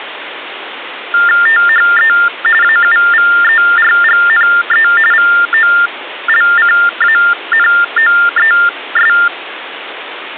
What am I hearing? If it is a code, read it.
TTY/TDD text telephone tones (45.45 baud Baudot), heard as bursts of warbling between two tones, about 400 Hz shift, 1600 Hz centre, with phone line noise. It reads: THE AUVERGNE VOLCANOES